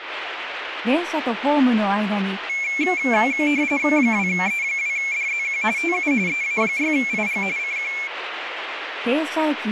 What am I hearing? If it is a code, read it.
RTTY (45.45 baud, 170 Hz shift), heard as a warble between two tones, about 2250 Hz centre, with radio static. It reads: 2E2DZQ TU EA6IG CQ